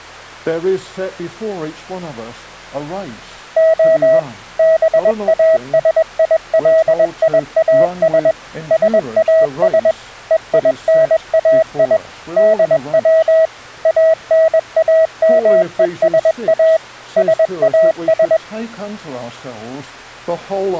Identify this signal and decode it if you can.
Morse code (Greek alphabet), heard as a keyed tone, machine-sent, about 21 wpm, 640 Hz. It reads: Ο ΒΑΣΙΛΙΑΣ ΣΑΣ ΕΙΝΑΙ ΔΩ ΑΝΑΜΕΣΑ ΣΑΣ